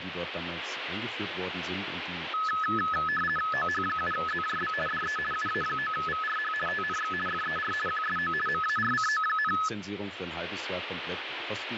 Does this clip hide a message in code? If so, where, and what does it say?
Yes: RTTY (50 baud, 450 Hz shift) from 2.3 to 9.7 s, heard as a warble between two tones, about 1500 Hz centre, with radio static and speech in German. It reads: OH7ZJB DE UA9VRH TNX FER QSO MARCO,